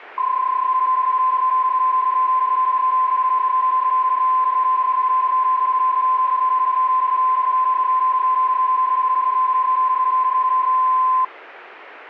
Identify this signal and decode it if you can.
PSK31 (31.25 baud), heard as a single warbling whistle, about 1030 Hz.